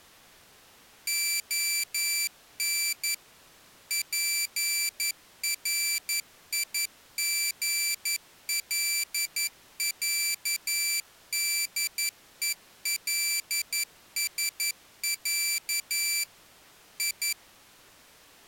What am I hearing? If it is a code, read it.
Morse code (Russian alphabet), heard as a high beeper, machine-sent, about 11 wpm, 2350 Hz. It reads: ОН ПРИГЛЯДЕЛСЯ И